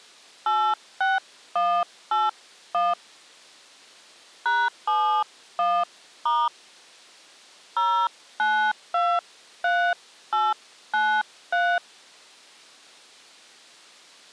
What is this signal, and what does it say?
DTMF, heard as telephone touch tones, dialled by hand, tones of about 250 ms. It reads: 86181 #71* 0923893